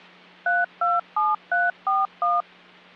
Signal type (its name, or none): DTMF